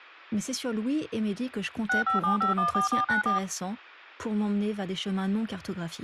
DTMF, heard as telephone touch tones, dialled by machine, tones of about 130 ms, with speech in French. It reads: 657514494